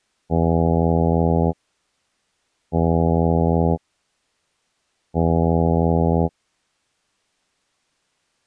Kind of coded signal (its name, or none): ship horn signal